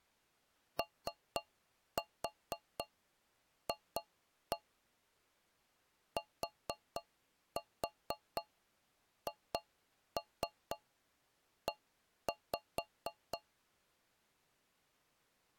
Tap code, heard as taps on a metal pipe, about 4 knocks a second. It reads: OF THE